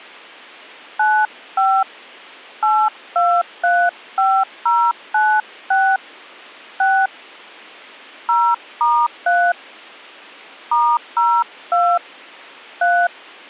DTMF, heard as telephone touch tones, dialled by hand, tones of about 260 ms. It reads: 95 8235096 6 0*3 *02 3